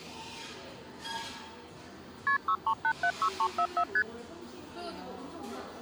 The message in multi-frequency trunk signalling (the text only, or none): KP 63876344 ST